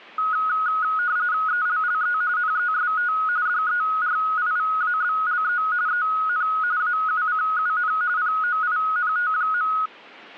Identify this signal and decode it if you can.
RTTY (45.45 baud, 170 Hz shift), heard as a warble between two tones, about 1360 Hz centre. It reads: ELLE NEST DERIVABLE EN AUCUN POINT.